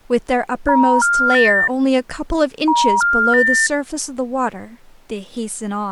Telephone call progress tone (ITU plan), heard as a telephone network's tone, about 950, 1400, 1800 Hz, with speech in English. Special information tone.